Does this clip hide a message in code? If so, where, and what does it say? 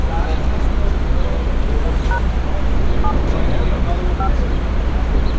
Yes: DTMF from 2.1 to 4.3 s, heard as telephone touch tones, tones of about 80 ms, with street noise. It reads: # 7 5